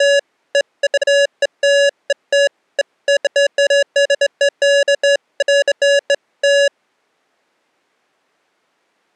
Beeps of irregular length. There is no code.